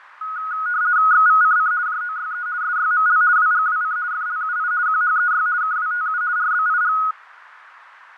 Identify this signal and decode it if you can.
RTTY (50 baud, 170 Hz shift), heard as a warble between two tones, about 1360 Hz centre, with radio static and fading. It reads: XVCC JOYE SYML WGWC FLUI QHEY KWTU RBIG